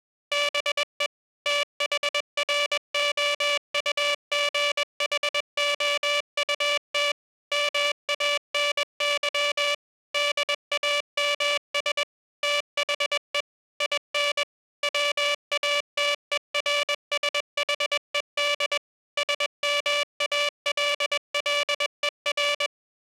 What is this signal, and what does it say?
Morse code, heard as a buzzer, machine-sent, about 21 wpm. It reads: BE THROUGHOUT MANY DAMS THE IN WATERSHED SMALLER